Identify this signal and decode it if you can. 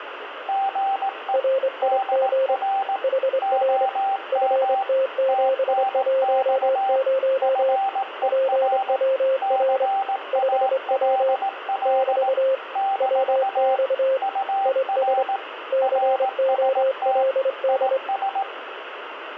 Morse code, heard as two keyed tones, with radio static. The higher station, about 18 wpm, 780 Hz: GE DR OM TNX FER CALL - UR RST IS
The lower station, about 24 wpm, 530 Hz: RIG HR FT710 PWR 5W <BT> WX IS COLD